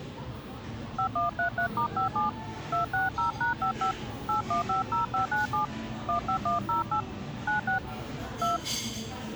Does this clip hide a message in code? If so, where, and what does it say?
Yes: DTMF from 1.0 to 8.6 s, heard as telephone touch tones, dialled by hand, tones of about 130 ms, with the noise of a crowd indoors. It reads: 5133*57 260#55 8150597 15108 96 2